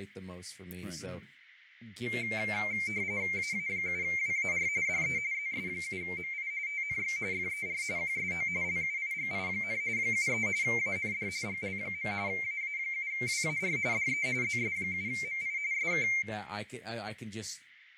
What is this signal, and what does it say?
RTTY (45.45 baud, 170 Hz shift), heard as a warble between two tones, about 2200 Hz centre, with radio static, fading, room echo and speech in English. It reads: AA7WAR DE ZS7MI TNX FER QSO LUIGI, 73 AND GL. AA7WAR DE ZS7MI SK